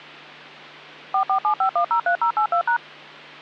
DTMF, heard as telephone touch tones, dialled by machine, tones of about 90 ms, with hum. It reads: 4475103082#